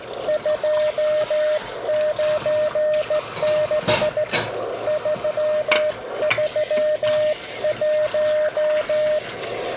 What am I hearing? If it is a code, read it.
Morse code, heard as a keyed tone, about 15 wpm, 610 Hz, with radio static, a narrow filter and kitchen noise. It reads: 296 331